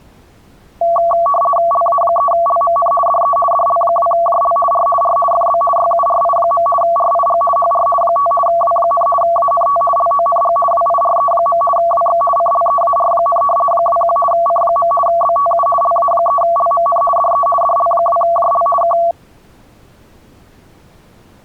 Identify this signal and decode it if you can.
RTTY (50 baud, 450 Hz shift), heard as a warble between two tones, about 900 Hz centre. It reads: LA3LMN DE DL2JL R R FB YURI. RIG HR 5 W, ANT LONG WIRE. WX CLEAR, 21 C. BTU LA3LMN DE DL2JL K